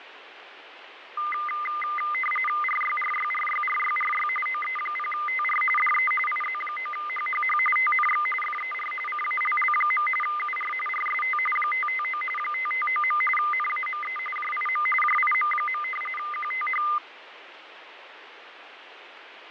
RTTY (45.45 baud, 850 Hz shift), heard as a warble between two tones, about 1650 Hz centre, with radio static and fading. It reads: RYRYRYRYRY OE0TR DE IZ9HHH TNX FER CALL. UR RST 559 559. NAME JIM JIM. QTH